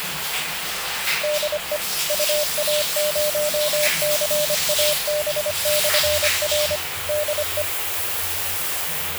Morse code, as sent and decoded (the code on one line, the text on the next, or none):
-.. . / ..- .- ----- -.-. .- -... -..-. .-. / -.. .
DE UA0CAB/R DE